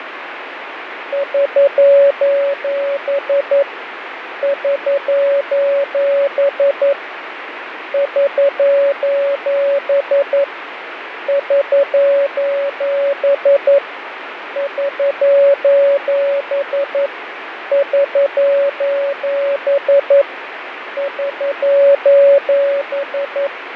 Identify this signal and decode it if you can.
Morse code, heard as a keyed tone, hand-sent with a paddle, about 11 wpm, 560 Hz, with radio static and fading. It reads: <SOS> <SOS> <SOS> <SOS> <SOS> <SOS> <SOS>